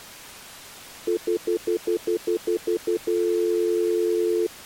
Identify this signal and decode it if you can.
Telephone call progress tone (North American plan), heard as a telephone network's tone, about 350, 440 Hz, 0.1 s on and 0.1 s off. Stutter dial tone.